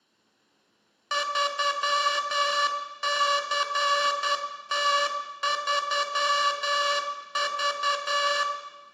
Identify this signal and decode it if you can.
Morse code, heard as a buzzer, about 10 wpm, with room echo. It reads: 3CT3V